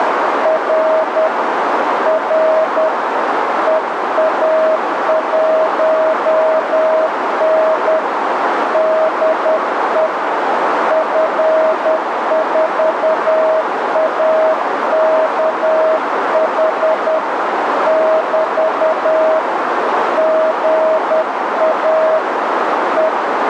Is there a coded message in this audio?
Yes: Morse code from 0.4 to 23.5 s, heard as a keyed tone, hand-sent with a paddle, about 10 wpm, 640 Hz, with heavy radio static and a narrow filter. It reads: R R EA1N DE F4AKH <BT> GA …